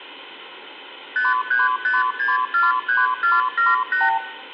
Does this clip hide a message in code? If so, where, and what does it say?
Yes: multi-frequency trunk signalling (R2, with the far end's replies) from 1.2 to 4.2 s, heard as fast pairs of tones, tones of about 170 ms, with room echo. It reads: 535643478